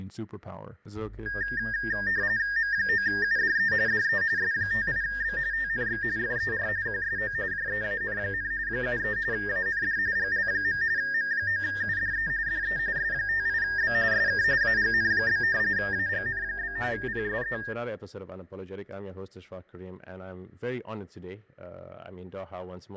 RTTY (45.45 baud, 170 Hz shift), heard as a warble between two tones, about 1750 Hz centre, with fading and static crashes. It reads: M9UDE DE S58B TNX FER QSO JEAN, 73 AND GL. M9UDE DE S58B SK AGN? AGN? PSE